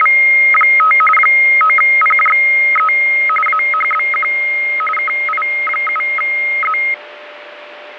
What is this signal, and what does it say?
RTTY (45.45 baud, 850 Hz shift), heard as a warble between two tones, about 1700 Hz centre, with radio static and a steady whistle near 590 Hz. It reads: … 9PJE AHBQ KI7Z